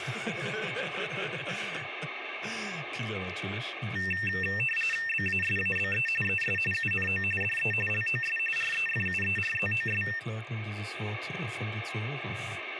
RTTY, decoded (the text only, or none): BASABE ES UNO DE LOS REFUERZOS